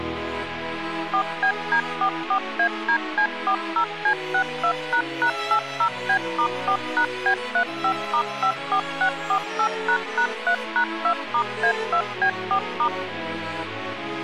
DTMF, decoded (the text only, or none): 4BD44ADC40C62##80B*4#B35*54648##3#2*A2B4*